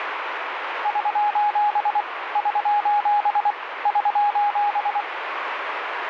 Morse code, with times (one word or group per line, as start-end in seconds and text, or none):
0.9-2.0 <SOS>
2.4-3.5 <SOS>
3.9-5.0 <SOS>